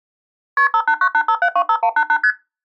Multi-frequency trunk signalling (R1, as on North American trunks), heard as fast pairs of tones, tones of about 70 ms. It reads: KP 58985725188 ST